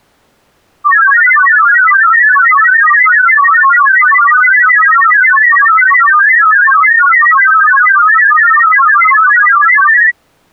Multi-tone FSK (Olivia or MFSK type), about 1000 Hz wide, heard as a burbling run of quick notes, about 31.25 baud.